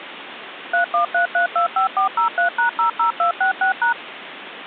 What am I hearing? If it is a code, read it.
DTMF, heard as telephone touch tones, dialled by machine, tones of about 110 ms, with phone line noise. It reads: 313325403#00266#